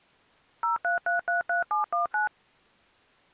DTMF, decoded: 03333719

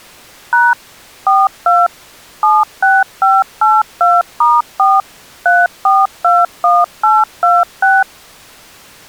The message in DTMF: # 42 76582*4 3421826

